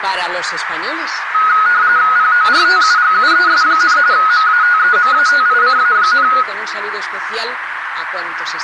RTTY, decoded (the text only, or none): PORTUGUES, MATEMATICA,